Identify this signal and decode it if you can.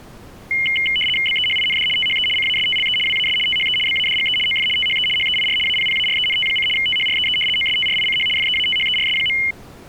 RTTY (75 baud, 850 Hz shift), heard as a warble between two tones, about 2550 Hz centre. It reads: BEHIND THE CASTLE WAS THE BADGE OF THE HEIR APPARENT: THREE OSTRICH FEATHERS.